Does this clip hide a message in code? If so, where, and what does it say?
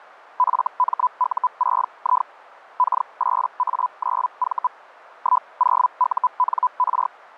Yes: Hellschreiber (Feld-Hell, 122.5 baud) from 0.4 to 7.1 s, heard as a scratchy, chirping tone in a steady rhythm, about 1000 Hz. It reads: FMU6I K8A9V 10UNR